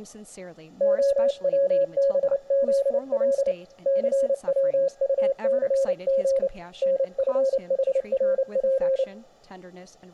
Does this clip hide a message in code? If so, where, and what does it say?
Yes: Morse code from 0.7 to 9.1 s, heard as a keyed tone, hand-sent with a paddle, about 29 wpm, 540 Hz, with speech in English. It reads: OWBZL CWUCG NFHRP